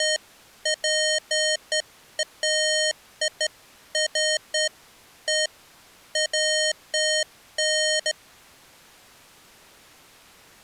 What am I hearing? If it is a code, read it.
Beeps of irregular length. There is no code.